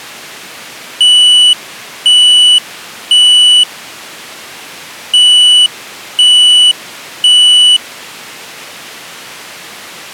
Alarm pattern, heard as an alarm's beeps, played twice, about 2950 Hz. Temporal three. Smoke or fire, evacuate.